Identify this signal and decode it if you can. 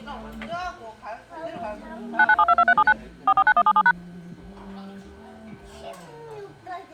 DTMF, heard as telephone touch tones, dialled by machine, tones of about 50 ms, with the noise of a crowd indoors. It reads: 99722379 449177#